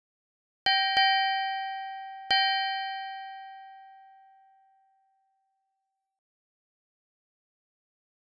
Ship's bell, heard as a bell. 3. Three half-hours of the watch have passed.